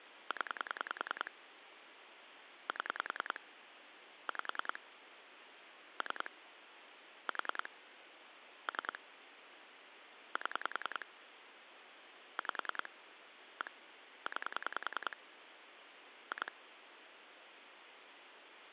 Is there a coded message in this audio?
Yes: pulse dialling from 0.3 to 16.5 s, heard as clicks on a phone line, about 10 pulses a second, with phone line noise. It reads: 0 7 5 3 4 3 7 5 1 9 2